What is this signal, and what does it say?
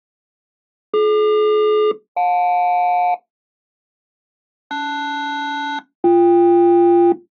Aircraft SELCAL, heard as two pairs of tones. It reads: DQ-JL LS-BK